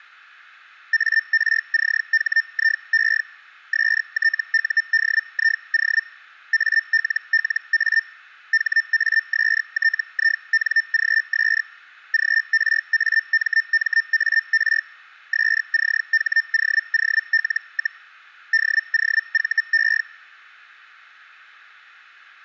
Hellschreiber (Feld-Hell, 122.5 baud), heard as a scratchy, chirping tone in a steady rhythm, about 1800 Hz. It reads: ARCHIE STUDIO ALLA HASTINGS GRAMMAR SCHOOL, DOVE